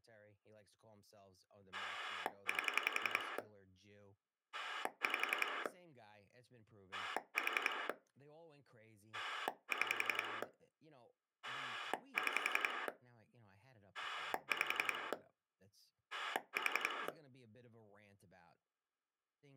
Pulse dialling, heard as a rotary dial, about 11 pulses a second, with speech in English. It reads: 8 5 4 6 6 5 4